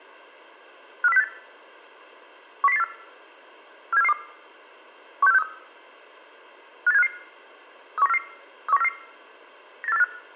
Five-tone selective call (EEA), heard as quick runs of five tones, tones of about 40 ms. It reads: 54068 10084 47442 16463 58755 31944 31944 98485